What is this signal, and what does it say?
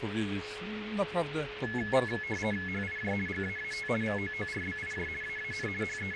RTTY (50 baud, 450 Hz shift), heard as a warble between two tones, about 1950 Hz centre, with radio static and a steady whistle near 420 Hz. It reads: HIJ GAAT VOORBIJ AAN …